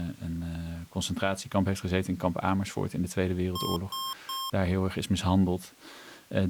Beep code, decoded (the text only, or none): 3 short